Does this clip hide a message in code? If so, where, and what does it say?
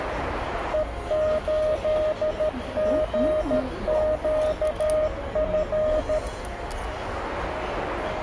Yes: Morse code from 0.7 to 6.2 s, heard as a keyed tone, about 13 wpm, 620 Hz, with radio static and the noise of a crowd indoors. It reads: E8GQF